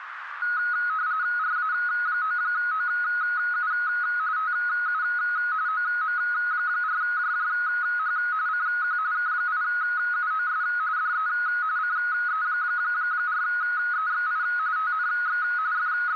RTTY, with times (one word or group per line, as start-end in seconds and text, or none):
1.4-3.7 RA9OU
4.4-5.0 TU
5.7-8.2 OM4JJH
8.5-9.0 CQ
9.1-10.6 K8UOS
11.0-11.3 DE
11.8-14.4 CE4EXI
14.8-15.4 TNX
15.7-16.2 …